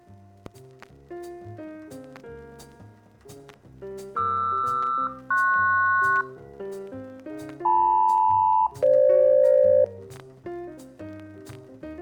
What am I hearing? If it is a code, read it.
Aircraft SELCAL, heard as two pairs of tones, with room echo. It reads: QR-PS LM-FG